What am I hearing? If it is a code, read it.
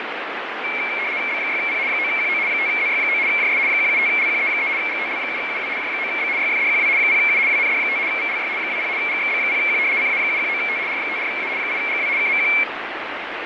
RTTY (75 baud, 170 Hz shift), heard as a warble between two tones, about 2250 Hz centre, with radio static and fading. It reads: B6P 9QO 5ZY9 JS 175LQE3 GTL7UW J9B YFDQW 0U WND5 VLY 20 GXB0Q CA719T R54A 8GW KMQ